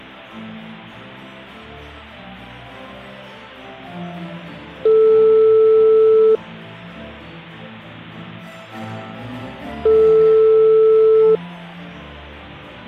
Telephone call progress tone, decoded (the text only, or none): ringback tone